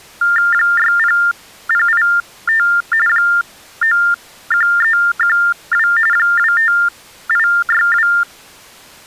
TTY/TDD text telephone tones (45.45 baud Baudot), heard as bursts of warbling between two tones, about 400 Hz shift, 1600 Hz centre. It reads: 60085 91312 25862